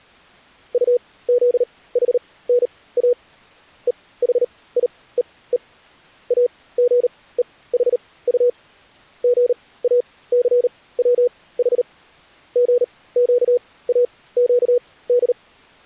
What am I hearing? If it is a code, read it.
Morse code (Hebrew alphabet), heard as a keyed tone, machine-sent, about 38 wpm, spaced as for 20 wpm, 490 Hz. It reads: טזחנא וחיוו אגוחט גאסצח גקאקד